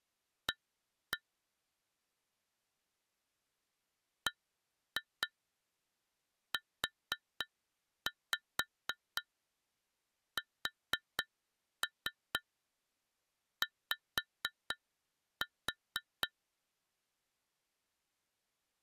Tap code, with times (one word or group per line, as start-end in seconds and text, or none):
0.5-1.2 A
4.3-16.3 BUSY